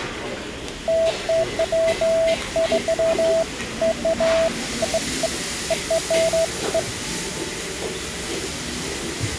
Beeps of irregular length, with the noise of a restaurant. There is no code.